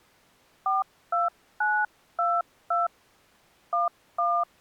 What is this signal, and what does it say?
DTMF, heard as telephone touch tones, dialled by hand, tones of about 190 ms. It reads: 42922 11